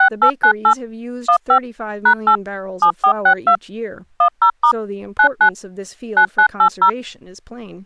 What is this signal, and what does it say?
DTMF, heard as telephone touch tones, dialled by machine, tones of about 80 ms, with speech in English. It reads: 6898 15 #8 7462 10* 99 9980